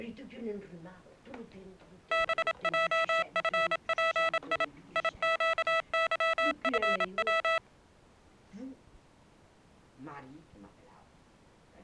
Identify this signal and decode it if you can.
Morse code, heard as electronic beeps, machine-sent, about 27 wpm, 660 Hz. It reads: BJFPI IQYFW